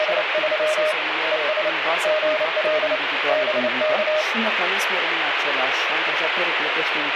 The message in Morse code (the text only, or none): … ES GL BK